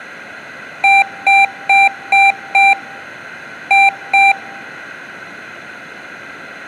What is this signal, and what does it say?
Beep code, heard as beeps from a small speaker, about 790 Hz, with room echo. 5-2.